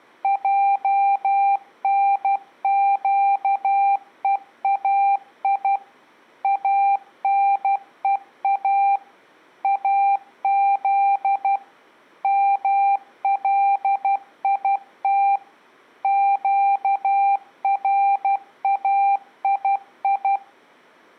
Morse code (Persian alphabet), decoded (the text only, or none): جنگهای انها از ملیت گرایی